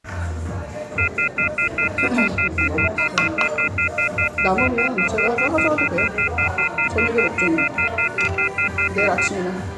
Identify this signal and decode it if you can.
Telephone call progress tone (North American plan), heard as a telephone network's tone, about 1400, 2050, 2450, 2600 Hz, 0.1 s on and 0.1 s off, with the noise of a restaurant. Off-hook warning tone.